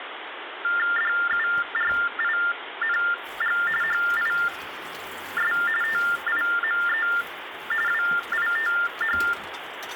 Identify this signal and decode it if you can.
TTY/TDD text telephone tones (45.45 baud Baudot), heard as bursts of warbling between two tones, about 400 Hz shift, 1600 Hz centre, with phone line noise and kitchen noise. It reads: DURING HIS TIME WITH